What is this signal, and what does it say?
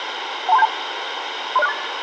Five-tone selective call (EIA), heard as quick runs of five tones, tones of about 30 ms, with radio hiss and room echo. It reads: 12372 30648